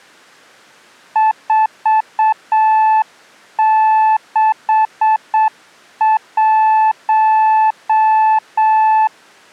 Morse code, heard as a keyed tone, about 7 wpm, 870 Hz. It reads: 461